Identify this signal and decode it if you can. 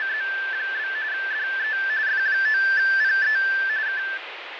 RTTY (45.45 baud, 170 Hz shift), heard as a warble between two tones, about 1650 Hz centre, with radio static and fading. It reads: … DE F9PE K